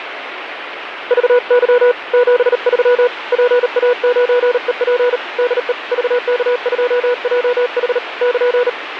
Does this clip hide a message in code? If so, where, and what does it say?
Yes: Morse code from 1.0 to 8.8 s, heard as a keyed tone, hand-sent with a bug key, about 38 wpm, 490 Hz, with radio static. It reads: VY 73 PA9EP DE VK2JH <KN>